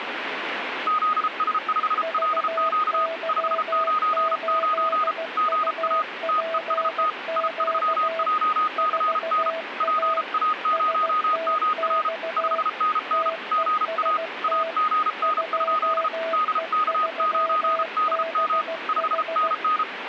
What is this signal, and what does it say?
Morse code, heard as two keyed tones, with radio static. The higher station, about 33 wpm, 1240 Hz: ZS5LQ 599 GA TEST I3JCN PA0MR 5NN GA AGN? DK9DM 5NN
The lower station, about 16 wpm, 660 Hz: VY8UPQ 4A STX TEST 2E3BH